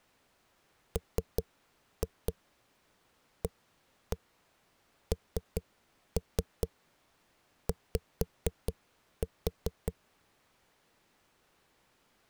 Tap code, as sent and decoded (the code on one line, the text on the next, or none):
3-2 1-1 3-3 5-4
MANY